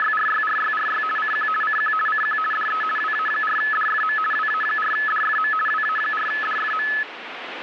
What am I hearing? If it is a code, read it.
RTTY (50 baud, 450 Hz shift), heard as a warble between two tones, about 1500 Hz centre, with radio static. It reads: … CQ CQ CQ DE WA4DFM WA4DFM WA4DFM